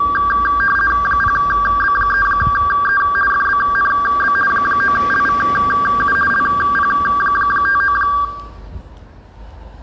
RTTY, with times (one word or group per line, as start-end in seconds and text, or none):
1.1-3.0 0B3E
3.3-4.3 FBNB
4.5-6.2 9LVU
6.3-8.0 LP59